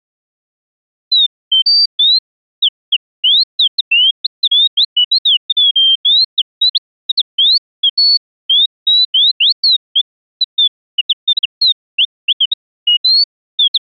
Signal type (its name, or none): none